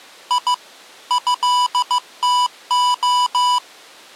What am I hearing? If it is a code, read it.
Morse code (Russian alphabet), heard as electronic beeps, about 15 wpm, 990 Hz. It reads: И ЭТО